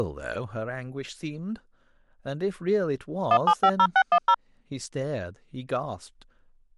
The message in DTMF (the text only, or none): 1750610